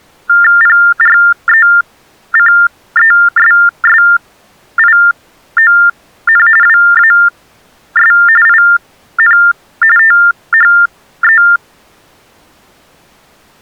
TTY/TDD text telephone tones (45.45 baud Baudot), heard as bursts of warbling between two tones, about 400 Hz shift, 1600 Hz centre. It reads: PRECESSION WAS IN THE